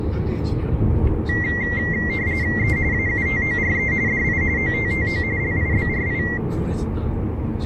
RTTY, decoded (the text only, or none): E AUTORE DI OTTO LIBRI